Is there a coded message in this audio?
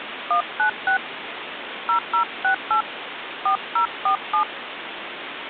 Yes: DTMF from 0.3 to 4.4 s, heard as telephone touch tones, dialled by hand, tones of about 100 ms, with phone line noise. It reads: 196 0068 4047